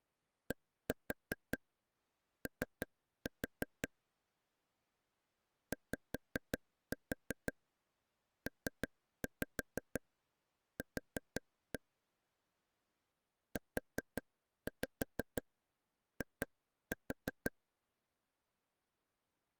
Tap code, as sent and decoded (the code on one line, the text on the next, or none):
1-4 3-4 / 5-4 3-5 4-1 / 4-5 2-4
DO YPQ UI